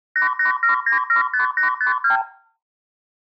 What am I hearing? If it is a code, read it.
Multi-frequency trunk signalling (R2, with the far end's replies), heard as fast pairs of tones, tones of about 120 ms, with room echo. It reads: 887975852